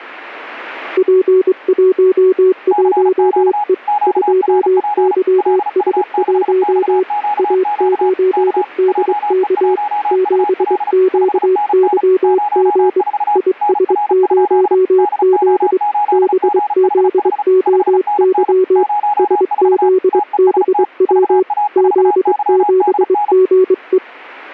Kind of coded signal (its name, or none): Morse code